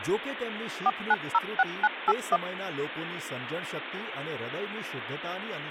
DTMF, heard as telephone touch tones, dialled by machine, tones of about 40 ms, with phone line noise and speech in Gujarati. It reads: 4906981